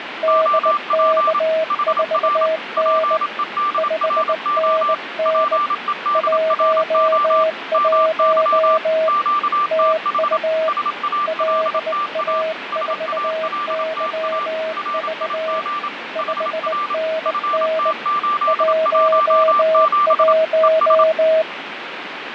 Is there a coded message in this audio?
Yes: Morse code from 0.2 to 21.5 s, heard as two keyed tones, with radio static and fading. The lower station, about 19 wpm, 640 Hz: DK4N 5NN 11 TU LA4YV 5NN 11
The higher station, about 27 wpm, 1180 Hz: OP HR PEDRO PEDRO MY QTH SALTA SALTA RIG HR FT817 ES